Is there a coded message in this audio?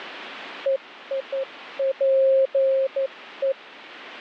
Yes: Morse code (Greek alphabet) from 0.6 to 3.6 s, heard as a keyed tone, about 12 wpm, 540 Hz. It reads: ΕΙΠΕ